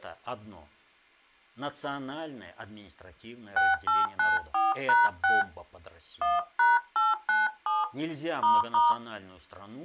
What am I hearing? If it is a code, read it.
DTMF, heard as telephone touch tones, dialled by hand, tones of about 180 ms, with speech in Russian. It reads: 6894#6 1#897 **